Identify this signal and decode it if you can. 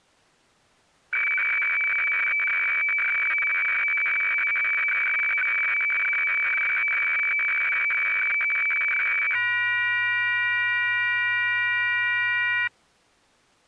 Weather fax (radiofax), 120 lines a minute, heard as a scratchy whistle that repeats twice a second.